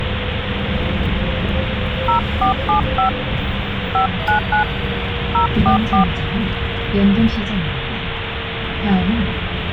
DTMF, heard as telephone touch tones, dialled by hand, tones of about 110 ms, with phone line noise and the noise inside a bus. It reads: 0475 599 044